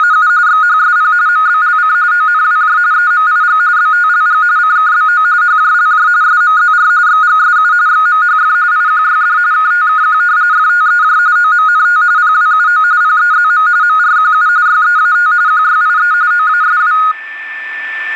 RTTY (45.45 baud, 170 Hz shift), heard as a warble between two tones, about 1350 Hz centre, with a steady whistle near 1770 Hz. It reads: … XHSP MBLC ONWJ EMIG BTLG CKBO HJLJ SMZR XGSU XMHF IQYD KTKQ FTEJ OMNT PWUO PEZM MRQU YEAT QYIE OASW